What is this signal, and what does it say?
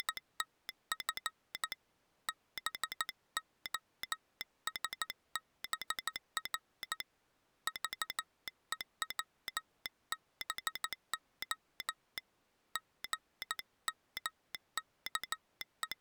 Morse code, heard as a telegraph sounder, hand-sent with a paddle, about 14 wpm. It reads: … BOSBR VEWBO …